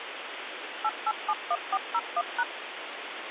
DTMF, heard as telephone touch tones, dialled by machine, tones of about 50 ms, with phone line noise. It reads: 8871401#